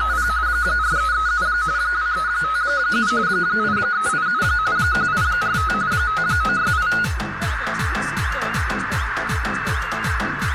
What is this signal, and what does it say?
RTTY (45.45 baud, 170 Hz shift), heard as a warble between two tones, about 1360 Hz centre, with radio static and a narrow filter. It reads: … 4337 2357 8387 1845 5968